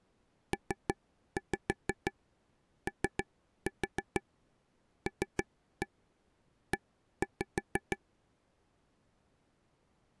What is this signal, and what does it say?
Tap code, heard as taps on a table, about 6 knocks a second. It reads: POLE